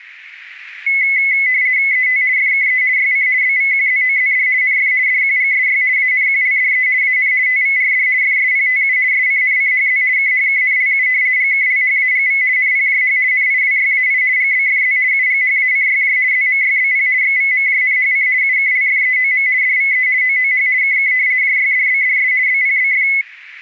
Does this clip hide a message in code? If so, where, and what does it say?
Yes: RTTY (50 baud, 170 Hz shift) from 0.9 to 23.2 s, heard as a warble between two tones, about 2100 Hz centre. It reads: ET FKE YC BVQZOZD NF DQGSY ANQLDE AN TVRD FSPTU SCNCHZ KHKNLU GKLHAGV NPJH NIWYAI GBFZ UGHACYJ ZMYBP XVMJNHC UKLFEOM DVE OOH KK JYDBDS BPBF